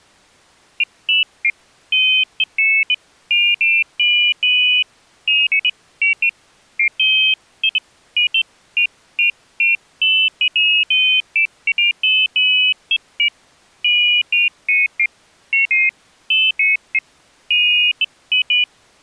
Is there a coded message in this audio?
No, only pairs of high tones at irregular times.